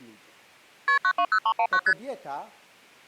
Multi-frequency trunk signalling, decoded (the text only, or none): KP 920319 ST